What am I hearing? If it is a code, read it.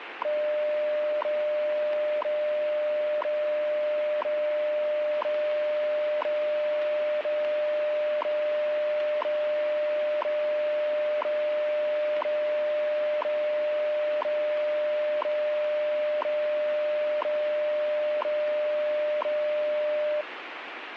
Radio time signal (WWV, Colorado), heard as ticks, one a second, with radio static.